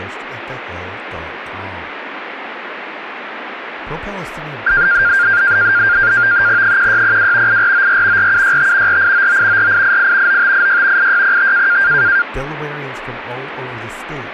NAVTEX (SITOR-B), 100 baud, 170 Hz shift, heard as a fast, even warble, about 1500 Hz centre, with radio static and speech in English. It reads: 1602 8494 4765 4899 4888 9586 8605